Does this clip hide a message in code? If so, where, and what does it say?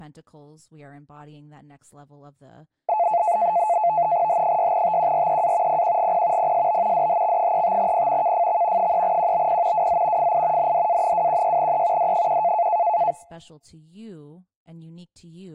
Yes: NAVTEX (SITOR-B), 100 baud, 170 Hz shift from 2.9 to 13.1 s, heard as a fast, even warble, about 780 Hz centre, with speech in English. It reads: H6TQREA PQGP PSB DHX35P KFX 3QBP WZ FI NDA216E D1